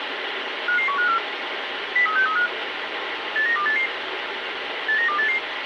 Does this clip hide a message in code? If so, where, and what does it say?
Yes: five-tone selective call (CCIR) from 0.7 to 5.4 s, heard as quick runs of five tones, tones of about 100 ms, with radio hiss. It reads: 55154 03635 89288 89288